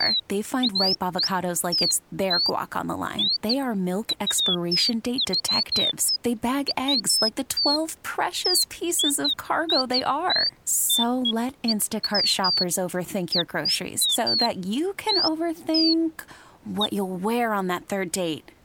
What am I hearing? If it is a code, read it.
Bird-like chirps, with speech in English. There is no code.